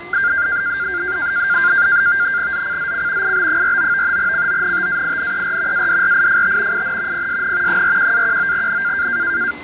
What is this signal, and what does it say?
NAVTEX (SITOR-B), 100 baud, 170 Hz shift, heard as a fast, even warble, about 1500 Hz centre, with fading, static crashes, a steady whistle near 2050 Hz and the noise of a restaurant. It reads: ZCZC IB49 CONTAINER ADRIFT IN PSN 41-19N